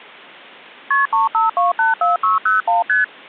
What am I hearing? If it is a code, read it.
Multi-frequency trunk signalling (R1, as on North American trunks), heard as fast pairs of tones, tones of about 150 ms. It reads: KP 35284601 ST